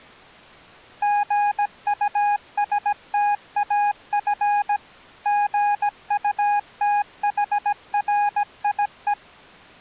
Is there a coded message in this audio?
Yes: Morse code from 1.0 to 9.2 s, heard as a keyed tone, machine-sent, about 17 wpm, 820 Hz. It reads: GUSTAF GUTHRIE